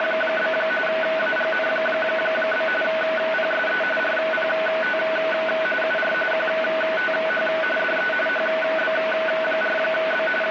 RTTY (45.45 baud, 850 Hz shift), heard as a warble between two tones, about 1070 Hz centre, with radio static. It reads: … AGN? PSE RPT UR QTH DE HB4B …